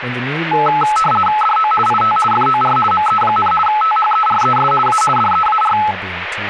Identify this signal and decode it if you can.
RTTY (50 baud, 450 Hz shift), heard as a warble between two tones, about 1080 Hz centre, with radio static and speech in English. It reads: DO IT FOR ME, THERES A DEAR